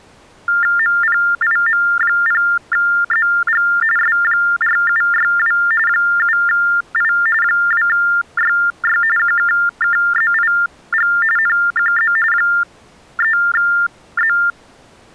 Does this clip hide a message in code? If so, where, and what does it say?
Yes: TTY/TDD text telephone tones (45.45 baud Baudot) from 0.5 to 14.5 s, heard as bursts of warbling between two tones, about 400 Hz shift, 1600 Hz centre. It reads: MPIM0ZG S4762 7I 2YY QKKZIG NQZ 3Z